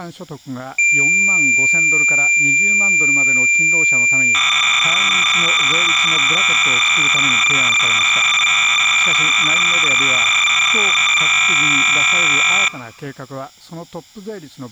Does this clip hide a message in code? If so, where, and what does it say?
Yes: cassette data (Kansas City type), 300 baud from 0.8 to 12.7 s, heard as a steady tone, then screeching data, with speech in Japanese.